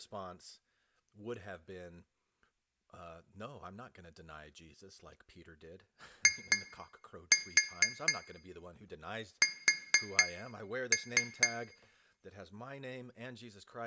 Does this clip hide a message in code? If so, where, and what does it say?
Yes: tap code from 6.3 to 11.6 s, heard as taps on glass, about 4 knocks a second, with room echo and speech in English. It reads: IS